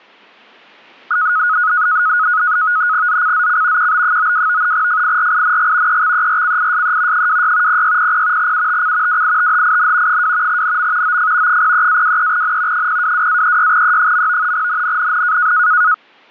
NAVTEX (SITOR-B), 100 baud, 170 Hz shift, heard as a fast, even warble, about 1360 Hz centre. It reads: ZCZC QB92 FIRING EXERCISE 26 0600 UTC WITHIN 2 NM OF 03-23N 022-36E. NNNN